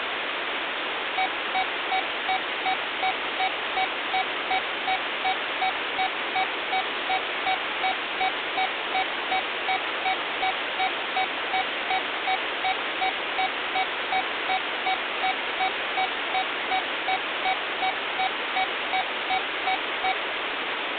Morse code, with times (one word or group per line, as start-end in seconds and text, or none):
none